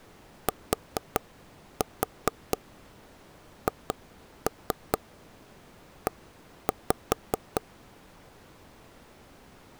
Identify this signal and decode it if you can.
Tap code, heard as taps on a table, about 4 knocks a second. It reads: THE